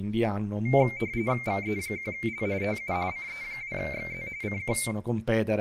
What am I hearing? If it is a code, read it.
RTTY (45.45 baud, 170 Hz shift), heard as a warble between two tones, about 2200 Hz centre, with room echo and speech in Italian. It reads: VE1L TU CE2XZ CQ